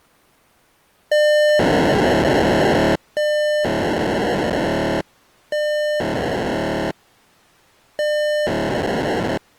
POCSAG pager data (1200 baud), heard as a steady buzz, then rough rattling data.